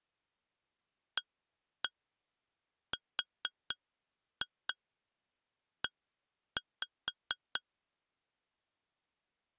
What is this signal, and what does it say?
Tap code, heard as taps on glass, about 4 knocks a second. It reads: ARE